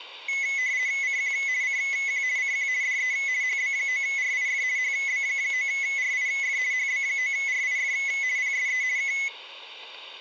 RTTY (50 baud, 170 Hz shift), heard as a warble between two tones, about 2100 Hz centre, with static crashes. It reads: CQ CQ CQ DE HB9RIF HB9RIF HB9RIF PSE K